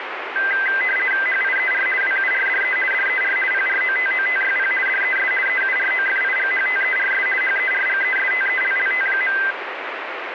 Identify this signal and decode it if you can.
RTTY (50 baud, 450 Hz shift), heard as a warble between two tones, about 1800 Hz centre, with radio static. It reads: HIER WURDE DER PROTOTYP DES EUROFIGHTERS HERGESTELLT.